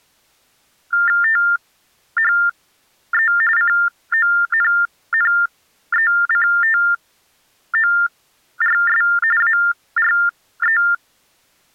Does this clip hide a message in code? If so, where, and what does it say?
Yes: TTY/TDD text telephone tones (45.45 baud Baudot) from 0.9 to 10.9 s, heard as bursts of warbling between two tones, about 400 Hz shift, 1600 Hz centre. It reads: THE CONNECTORS ARE